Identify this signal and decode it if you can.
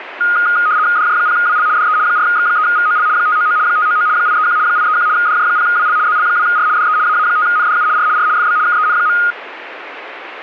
RTTY (75 baud, 170 Hz shift), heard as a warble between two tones, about 1340 Hz centre, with radio static. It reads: DJ0WL DE 4X3VOL 599 599 831 831 DJ0WL ZL2R DE AA5NDU R R FB KEN.